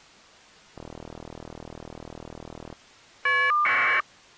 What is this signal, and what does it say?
Caller ID data burst, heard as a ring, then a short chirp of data, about 1200 baud.